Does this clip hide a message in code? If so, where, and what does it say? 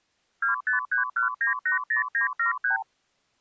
Yes: multi-frequency trunk signalling (R2, with the far end's replies) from 0.4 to 2.8 s, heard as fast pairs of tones, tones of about 120 ms. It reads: 2531980973